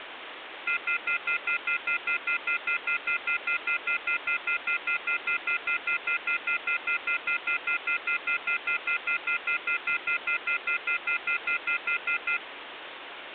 Telephone call progress tone (North American plan), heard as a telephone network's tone, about 1400, 2050, 2450, 2600 Hz, 0.1 s on and 0.1 s off, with phone line noise. Off-hook warning tone.